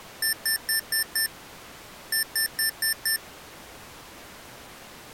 Beep code, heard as beeps from a small speaker, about 1800 Hz. 5-5.